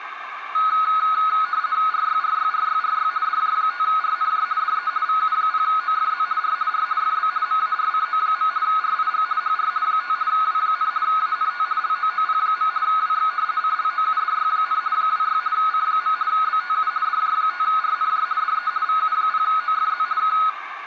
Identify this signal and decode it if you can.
RTTY (50 baud, 170 Hz shift), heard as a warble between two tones, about 1360 Hz centre, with radio static, a narrow filter and room echo. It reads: RYRYRYRY DJ5RNJ DE VU0OFZ R R FB MARCO. RIG HR 5 W, ANT LOOP. WX CLOUDY, 26 C. BTU DJ5RNJ DE VU0OFZ K